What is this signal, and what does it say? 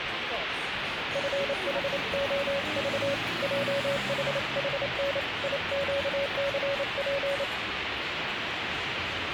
Morse code, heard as a keyed tone, hand-sent with a paddle, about 28 wpm, 560 Hz, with radio static and street noise. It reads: FHOV JHHN IQCP